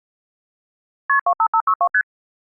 Multi-frequency trunk signalling (R1, as on North American trunks), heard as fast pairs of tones, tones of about 70 ms. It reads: KP 25562 ST